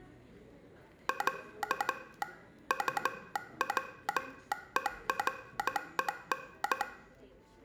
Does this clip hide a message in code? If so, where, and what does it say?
Yes: Morse code (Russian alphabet) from 1.0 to 6.9 s, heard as a telegraph sounder, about 14 wpm, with room echo and the noise of a cafe. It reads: Я УВЕРЕН